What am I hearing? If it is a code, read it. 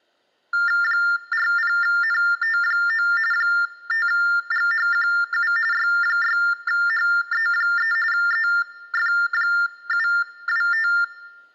TTY/TDD text telephone tones (45.45 baud Baudot), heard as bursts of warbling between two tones, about 400 Hz shift, 1600 Hz centre. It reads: 40NT9 5GHQU Y6HE3 EF725